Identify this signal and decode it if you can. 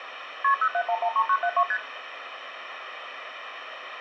Multi-frequency trunk signalling (R1, as on North American trunks), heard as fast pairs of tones, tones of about 70 ms, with phone line noise and room echo. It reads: KP 07113972 ST